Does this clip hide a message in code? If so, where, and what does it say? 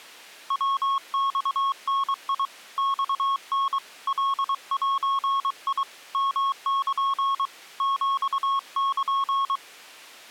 Yes: Morse code (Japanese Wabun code) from 0.4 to 9.6 s, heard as a keyed tone, hand-sent with a paddle, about 23 wpm, 1100 Hz. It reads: ヤマダ マタ カゼ ヨル ヒル